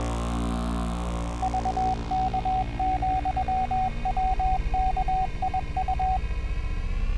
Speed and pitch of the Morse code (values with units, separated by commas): 21 wpm, 750 Hz